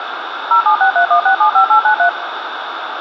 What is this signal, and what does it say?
DTMF, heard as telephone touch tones, dialled by machine, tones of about 100 ms, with radio hiss and room echo. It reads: 07631675893